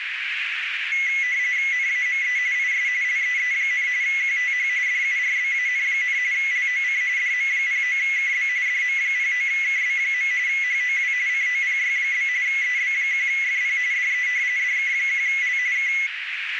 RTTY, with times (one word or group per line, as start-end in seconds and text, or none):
1.7-2.4 NAME
2.6-2.9 IS
3.0-3.9 LEE,
4.0-4.7 QTH
4.9-6.2 DURBAN,
6.3-7.0 LOC
7.2-8.5 DM09KB
8.7-10.3 DM09KB.
10.5-11.1 HOW
11.3-12.3 COPY?
12.5-13.8 EB1FP
13.9-14.3 DE
14.6-15.6 DK1L
15.8-15.9 K